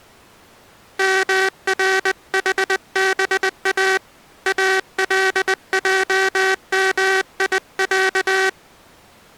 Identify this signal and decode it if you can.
Morse code (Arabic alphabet), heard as a buzzer, hand-sent with a bug key, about 20 wpm. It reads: مرحبا الجميع